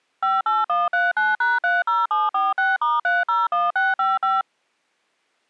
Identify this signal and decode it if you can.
DTMF, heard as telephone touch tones, dialled by machine, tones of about 180 ms. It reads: 58139#30746*301655